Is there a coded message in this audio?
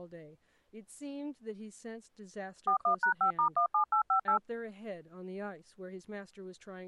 Yes: DTMF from 2.7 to 4.4 s, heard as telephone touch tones, dialled by machine, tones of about 100 ms, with speech in English. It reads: 41#5*17858